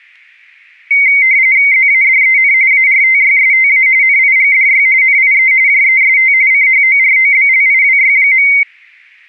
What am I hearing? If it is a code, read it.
RTTY (45.45 baud, 170 Hz shift), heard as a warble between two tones, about 2150 Hz centre, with static crashes. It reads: ZADEN ARTYSTA NIGDY NIE JEST CHOROBLIWY.